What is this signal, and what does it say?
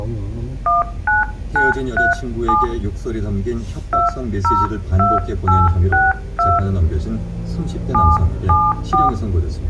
DTMF, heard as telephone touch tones, dialled by hand, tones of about 220 ms, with the noise inside a car. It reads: 19937 202862 774